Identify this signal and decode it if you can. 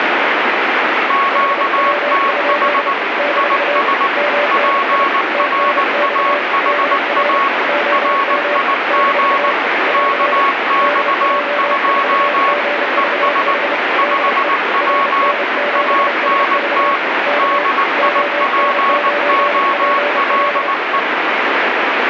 Morse code, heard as two keyed tones, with heavy radio static. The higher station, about 19 wpm, 1110 Hz: QTH IS PRAHA RIG KX2 ES 5W ANT DIPOLE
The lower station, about 30 wpm, 580 Hz: HW? - MNI TNX DR OM - <AR> DJ4GVH DE RN7SV K ON9PL